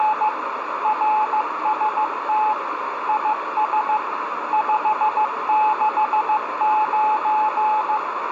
Morse code, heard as a keyed tone, machine-sent, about 15 wpm, 860 Hz, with radio static and a narrow filter. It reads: … RST IS 569